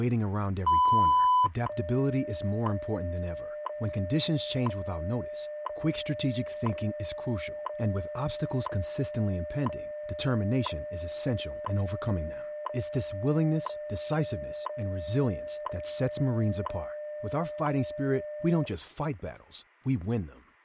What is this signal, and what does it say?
Radio time signal (WWV, Colorado), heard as ticks, one a second, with speech in English.